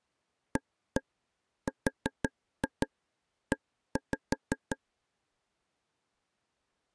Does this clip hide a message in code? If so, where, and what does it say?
Yes: tap code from 0.6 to 4.8 s, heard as taps on a table, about 5 knocks a second. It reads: ARE